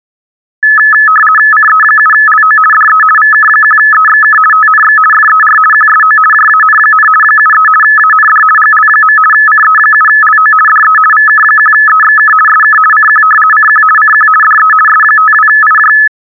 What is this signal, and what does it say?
RTTY (50 baud, 450 Hz shift), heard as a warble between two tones, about 1500 Hz centre. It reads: CE7LO DE VK1EXK TNX FER QSO JAN, 73 AND GL. CE7LO DE VK1EXK SK CQ CQ CQ DE S52IJ